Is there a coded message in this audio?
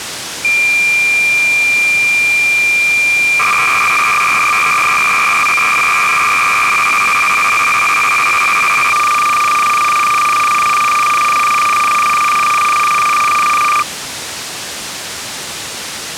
Yes: cassette data (Kansas City type), 300 baud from 0.4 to 13.8 s, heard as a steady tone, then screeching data, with tape hiss.